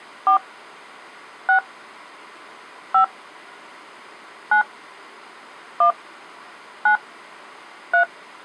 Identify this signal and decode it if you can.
DTMF, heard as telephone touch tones, dialled by hand, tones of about 100 ms. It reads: 4 6 5 9 1 9 3